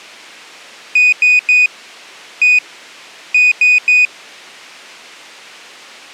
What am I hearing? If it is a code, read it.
Beep code, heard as a piezo beeper, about 2500 Hz. 3-1-3. In Phoenix BIOS tables: interrupt mask register failure.